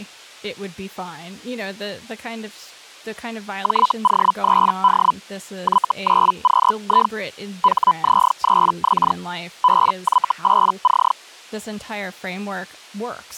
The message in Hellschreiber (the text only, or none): JO3D Y9QI HZ3X BY8C